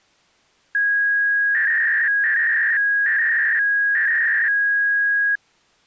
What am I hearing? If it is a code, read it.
300-baud modem data (V.21 tones), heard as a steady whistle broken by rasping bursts, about 300 baud, 200 Hz shift.